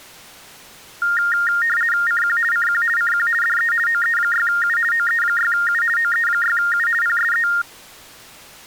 RTTY (50 baud, 450 Hz shift), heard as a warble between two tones, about 1650 Hz centre. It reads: CQ CQ CQ DE OE6U OE6U OE6U PSE